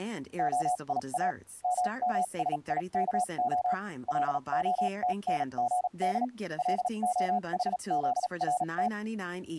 Morse code (Hebrew alphabet), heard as a keyed tone, machine-sent, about 37 wpm, spaced as for 31 wpm, 730 Hz, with speech in English. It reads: היא ממשיכה להתנגד להחזרת